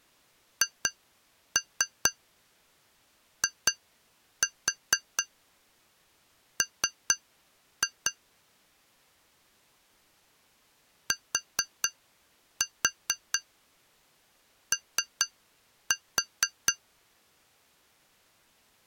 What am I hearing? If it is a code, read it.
Tap code, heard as taps on glass, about 4 knocks a second. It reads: HIM TO